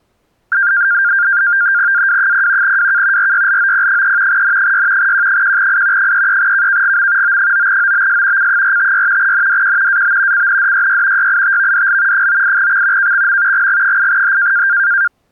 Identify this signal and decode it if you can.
NAVTEX (SITOR-B), 100 baud, 170 Hz shift, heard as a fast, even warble, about 1500 Hz centre. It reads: AW0 WK RYLOP3 N6 Q1I 33KKGM O9OBS C456 NDQ AB CNDYY YITVDL 98X KXM GG8H